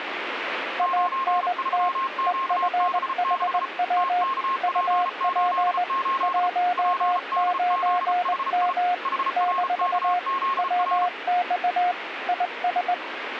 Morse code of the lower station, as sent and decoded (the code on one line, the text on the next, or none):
.- -. - / . ..-. .... .-- / ..- .--. / .---- ----. -- / -....- / .-- -..- / .. ...
ANT EFHW UP 19M - WX IS